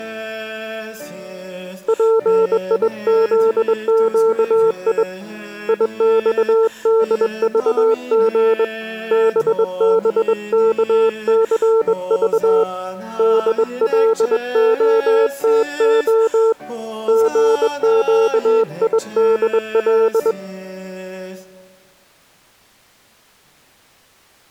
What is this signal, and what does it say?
Morse code, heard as a keyed tone, hand-sent with a straight key, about 21 wpm, 450 Hz. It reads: PIZQI IXDVG BBKCV DLOTO GQIDL